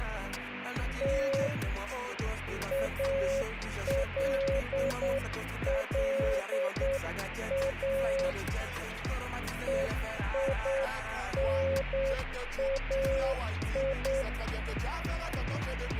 Morse code (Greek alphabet), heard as a keyed tone, hand-sent with a straight key, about 8 wpm, 540 Hz, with radio static. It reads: Τ ΑΛΛΑ ΕΙΝΑΙ